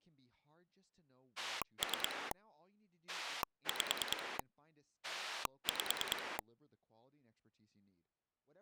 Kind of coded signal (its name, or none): pulse dialling